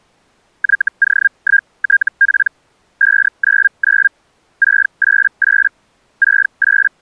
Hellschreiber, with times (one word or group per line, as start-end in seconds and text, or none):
0.6-2.5 YO1TP
3.0-4.1 599
4.6-5.7 688
6.2-7.0 …